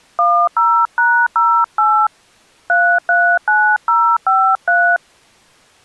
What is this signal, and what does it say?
DTMF, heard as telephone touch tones, dialled by hand, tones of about 290 ms. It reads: 10#08 339053